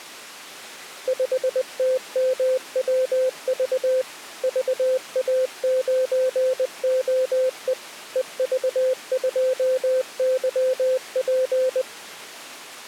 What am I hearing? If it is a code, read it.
Morse code, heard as a keyed tone, machine-sent, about 20 wpm, 520 Hz. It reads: 5TMWV VA9OE EV2YP